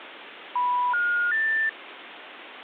Telephone call progress tone (North American plan), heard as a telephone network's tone, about 980, 1430, 1800 Hz, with phone line noise. Special information tone.